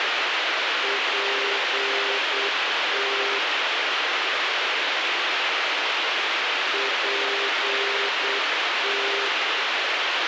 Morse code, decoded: PT PT

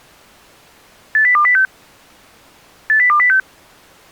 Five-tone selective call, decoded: 80206 80206

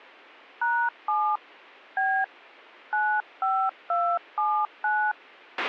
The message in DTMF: #7 B 95279

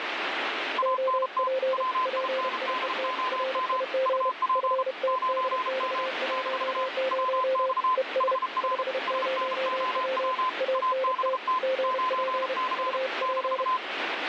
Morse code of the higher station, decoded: ANT WINDOM UP 9M - WX HR SNOW ABT 9C -

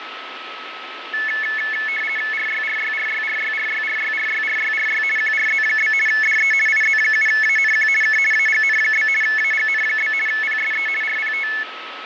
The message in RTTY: RYRYRYRYRYRYRYRYRY QRZ? DE IZ7ANQ K AGN? AGN? PSE RPT

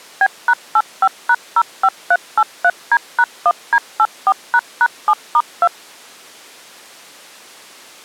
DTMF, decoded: B#85#05383D#1D84##7*2

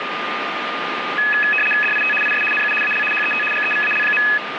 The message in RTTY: DIT IS NU AL HET GEVAL.

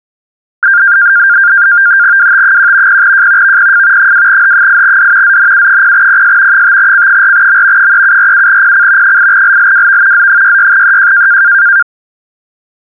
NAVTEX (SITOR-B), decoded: WT1 0J VPF 2H8D ZNU0PS 5C4M 3747PC 8LLWV Z66EJ

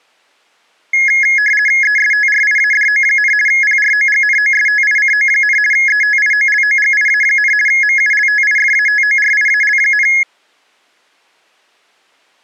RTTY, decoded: ESTRIADO, PROGNOSTICO, ETIOLOGIA, MULTIFATORIAL,

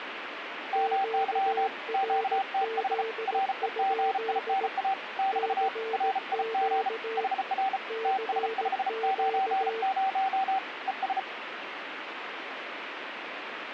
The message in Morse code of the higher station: MY QTH REGINA <BT> RIG HR TS590 ES

